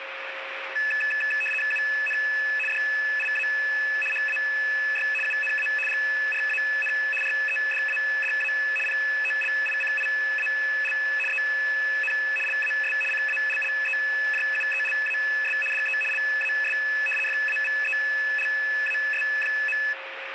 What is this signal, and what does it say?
RTTY (75 baud, 850 Hz shift), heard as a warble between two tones, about 2150 Hz centre, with radio static and a steady whistle near 540 Hz. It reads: UN DIA HAY UNA GRAN REDADA POLICIAL EN LAS CALLEJUELAS DE LAS FAVELAS.